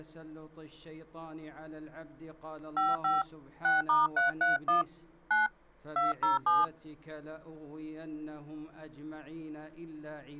DTMF, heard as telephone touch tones, dialled by hand, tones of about 160 ms. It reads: 55 6*331 9 207